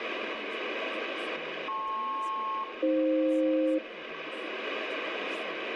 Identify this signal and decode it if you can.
Aircraft SELCAL, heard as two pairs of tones, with radio static, room echo and speech in English. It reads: LP-AF